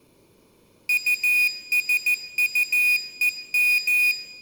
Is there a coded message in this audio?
Yes: Morse code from 0.8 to 4.2 s, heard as a high beeper, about 14 wpm, 2450 Hz, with room echo. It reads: USUEM